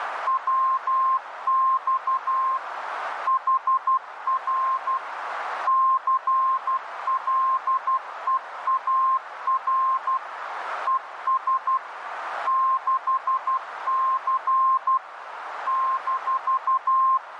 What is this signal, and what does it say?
Morse code, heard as a keyed tone, machine-sent, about 12 wpm, 1060 Hz, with radio static and a narrow filter. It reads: WX HR CLEAR ES 6C -